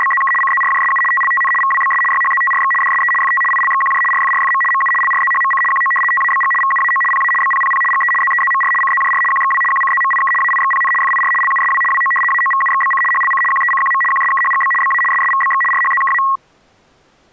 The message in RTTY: … CZRJSU TLTN VWBS YHZTRX DSE FT ILXQJ RFRFM MU LRZHMC QO TABG VUAO PA BPPP GE ZEZMR CZJR QXW QCZMIK AIXPN FIR LUSW WO AOVUXBC HLC QECQM QSKHGB BA SSVBX RHZKA

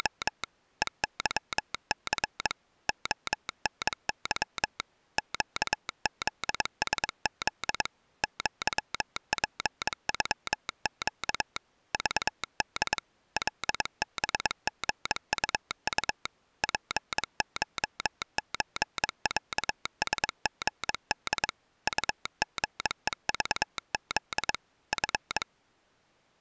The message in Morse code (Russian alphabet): … ЕЫЦ ОНЫ ЩЗСЗ ЪПЮЩ ЖД ЛБГУУ ПШЧЯСГД УГЕЖЗ Ф

